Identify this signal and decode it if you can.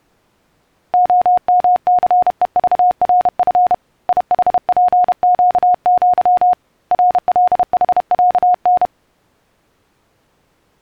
Morse code (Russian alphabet), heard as a keyed tone, hand-sent with a paddle, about 31 wpm, 720 Hz. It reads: ОМЦЕЖРФ ИХПЩЪ РЛХЯН